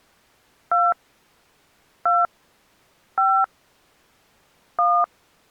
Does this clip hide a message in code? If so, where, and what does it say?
Yes: DTMF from 0.7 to 5.0 s, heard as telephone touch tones, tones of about 220 ms. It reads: 2 2 5 1